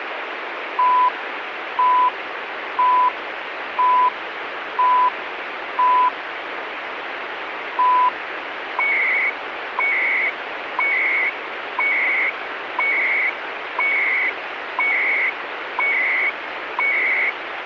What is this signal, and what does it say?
Radio time signal (CHU, Canada), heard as beeps and data bursts, one a second, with radio static.